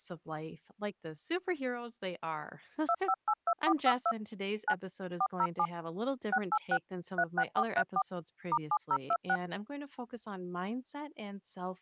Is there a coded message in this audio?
Yes: DTMF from 2.9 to 9.4 s, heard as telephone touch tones, dialled by machine, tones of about 60 ms, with speech in English. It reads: 2582452 9 407 686 36434 *7026